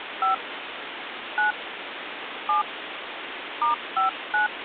DTMF, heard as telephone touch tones, dialled by hand, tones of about 130 ms, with phone line noise. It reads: 5 9 7 *59